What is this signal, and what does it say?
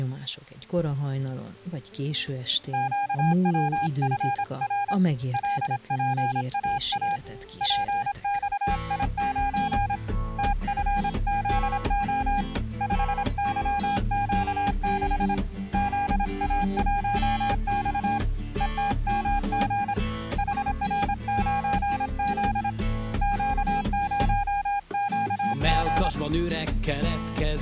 Morse code, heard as a keyed tone, hand-sent with a paddle, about 26 wpm, 810 Hz. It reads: QWFR LPAA PXI9 TFZO 5YQ6 ZA1X ETMG HR9Z Q0QG